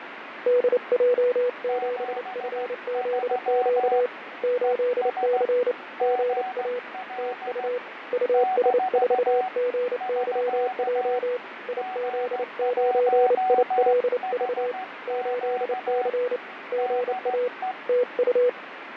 Morse code, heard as two keyed tones, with radio static and fading. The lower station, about 29 wpm, 490 Hz: DJ7FZQ 8C GA TU US4GYJ IZ9ILV 8C GA TU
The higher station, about 15 wpm, 750 Hz: 73 ES GL - <SK> G1HQ DE